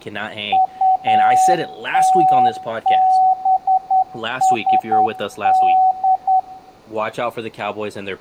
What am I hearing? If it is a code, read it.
Morse code, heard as a keyed tone, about 10 wpm, 750 Hz, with room echo and speech in English. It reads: UTBSD